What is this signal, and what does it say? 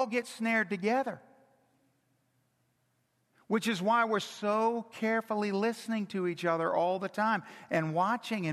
Speech in English. There is no code.